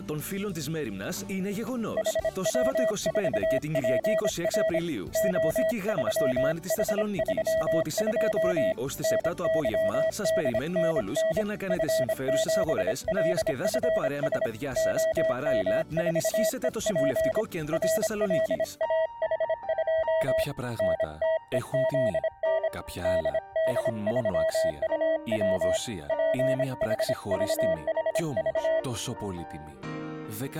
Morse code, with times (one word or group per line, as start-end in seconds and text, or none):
2.0-4.8 HW4PR
5.2-8.7 O3H32
9.0-11.4 NYDNN
11.7-14.5 F7LFS
14.8-17.4 OM4EP
17.7-20.4 RLAH2
20.8-22.7 NTEZN
23.0-25.8 DD3UW
26.1-28.8 PHVHV